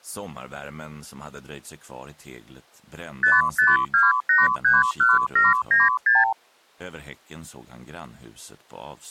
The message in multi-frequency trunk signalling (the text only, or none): 552831796